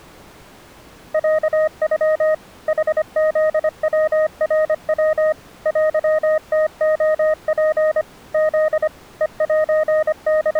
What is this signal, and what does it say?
Morse code (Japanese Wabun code), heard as a keyed tone, machine-sent, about 25 wpm, 620 Hz. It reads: ロノ ヌフヤナヤ テムレツ フ …